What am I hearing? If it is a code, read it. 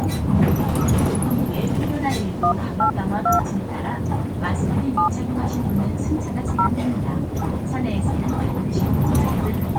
DTMF, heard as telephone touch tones, dialled by hand, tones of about 100 ms, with the noise inside a bus. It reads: 182 7 0